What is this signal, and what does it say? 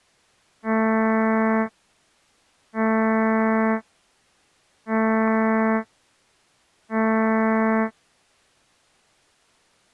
Ship horn signal, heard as a ship's horn, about 220 Hz. 4 short. At sea: a pilot vessel's identity signal in fog.